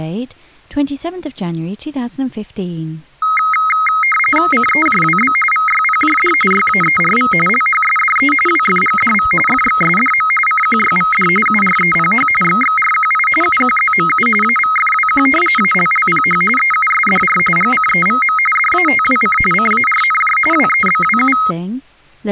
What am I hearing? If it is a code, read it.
RTTY (45.45 baud, 850 Hz shift), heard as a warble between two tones, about 1700 Hz centre. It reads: CEJWB VYPJD YAERV LHSDE WFGDV FXSDM CQYVD UREPH XXRQI UQZMU AVFWQ ALLPH EUSDR GCEVM DATWC CARNJ WEBWU